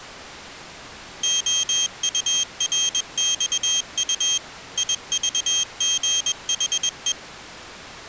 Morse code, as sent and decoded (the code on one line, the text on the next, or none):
--- ..- .-. -..- ..- / .. ...- --. .... .
OURXU IVGHE